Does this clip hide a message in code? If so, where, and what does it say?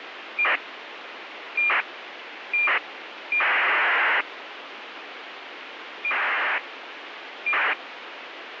Yes: ACARS aircraft data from 0.4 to 7.7 s, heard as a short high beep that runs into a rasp, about 2400 baud, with radio hiss.